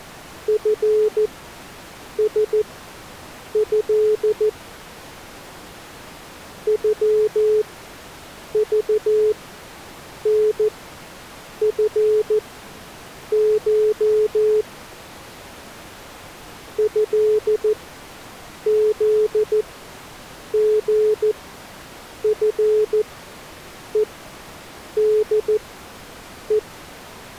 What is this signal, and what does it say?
Morse code (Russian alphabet), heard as a keyed tone, machine-sent, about 14 wpm, spaced as for 7 wpm, 430 Hz. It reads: ФСЭ ЮЖНФШ ЭЗГФЕДЕ